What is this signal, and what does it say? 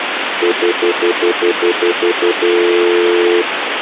Telephone call progress tone (North American plan), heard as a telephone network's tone, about 350, 440 Hz, 0.1 s on and 0.1 s off, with phone line noise. Stutter dial tone.